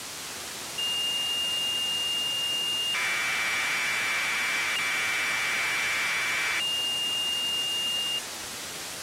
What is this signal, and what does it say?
Commodore tape loading (standard loader), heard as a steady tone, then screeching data, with tape hiss.